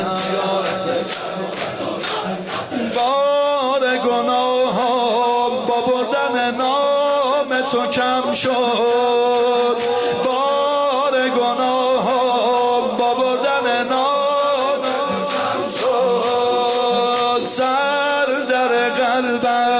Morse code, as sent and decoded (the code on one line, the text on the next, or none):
none